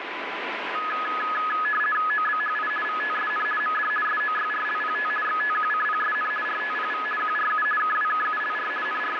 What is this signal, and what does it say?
RTTY (50 baud, 450 Hz shift), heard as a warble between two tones, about 1480 Hz centre, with radio static. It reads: OBHI VTSN MD SOYRLPT XTQCPSN RTPV QRU KWKULR …